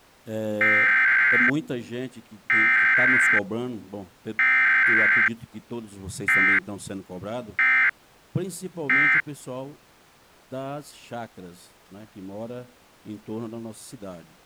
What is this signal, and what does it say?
Emergency Alert System (SAME) tones (header bursts, then end-of-message bursts), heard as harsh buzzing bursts, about 520.83 baud.